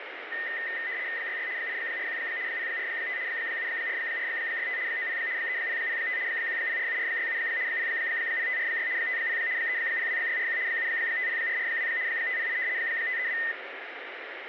RTTY (75 baud, 170 Hz shift), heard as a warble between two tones, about 1900 Hz centre, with radio static. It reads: 66 841 045 74465 90 3005 1047467 00546 50 302641 750442 508 532